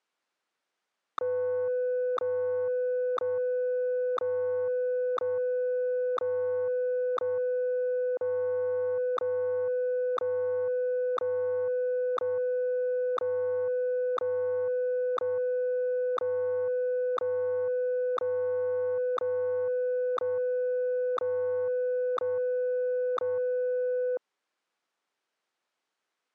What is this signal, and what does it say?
Radio time signal (WWVH, Hawaii), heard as ticks, one a second.